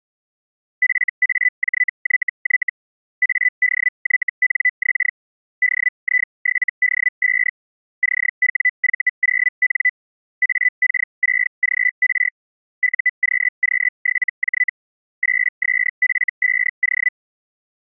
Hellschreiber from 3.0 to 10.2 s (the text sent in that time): ADYNX DI7D5 CWV0N